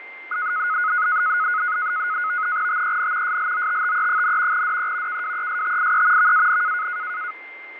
NAVTEX (SITOR-B), 100 baud, 170 Hz shift, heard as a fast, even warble, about 1360 Hz centre, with radio static, fading and a steady whistle near 2090 Hz. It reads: TEN SLOTTE, DE KWESTIE VAN